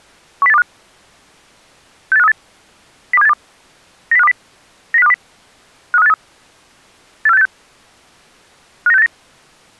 Five-tone selective call (EEA), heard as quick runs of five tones, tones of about 40 ms. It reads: 10825 68538 02782 90520 90520 53583 84686 59689